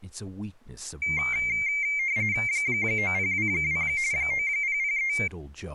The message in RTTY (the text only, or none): 9022 9003